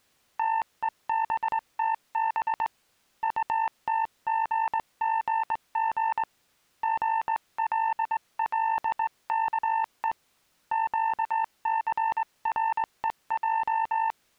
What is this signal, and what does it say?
Morse code, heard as a keyed tone, hand-sent with a straight key, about 20 wpm, 900 Hz. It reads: TEBTB UTGGG GLLKE QCREJ